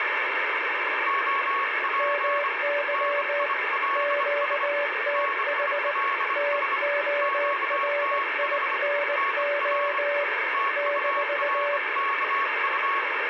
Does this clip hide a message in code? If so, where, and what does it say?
Yes: Morse code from 1.0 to 13.1 s, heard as two keyed tones, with heavy radio static. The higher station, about 25 wpm, 1110 Hz: OP NILS NILS QTH NR TURKU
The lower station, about 19 wpm, 580 Hz: MY QTH TORINO -